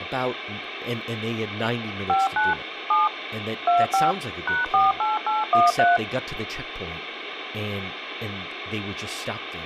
DTMF, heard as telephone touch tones, dialled by machine, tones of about 170 ms, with phone line noise and speech in English. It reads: 59 7 25 #48813